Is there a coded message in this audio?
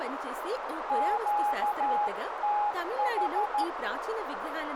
Yes: Morse code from 0.8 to 3.7 s, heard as a keyed tone, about 13 wpm, 830 Hz, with radio static, a narrow filter and speech in Telugu. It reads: QTH